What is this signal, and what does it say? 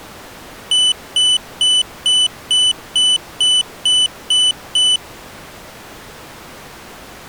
Beep code, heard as a piezo beeper, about 3000 Hz. 10 short. In AMI BIOS tables: CMOS shutdown register error.